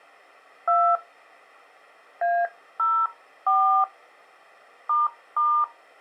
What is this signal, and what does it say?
DTMF, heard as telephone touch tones, dialled by hand, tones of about 270 ms. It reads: 2 A04 **